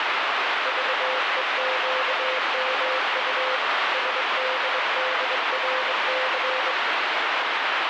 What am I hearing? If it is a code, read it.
Morse code, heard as a keyed tone, hand-sent with a straight key, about 22 wpm, 520 Hz, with heavy radio static. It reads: VEQMU SDDRC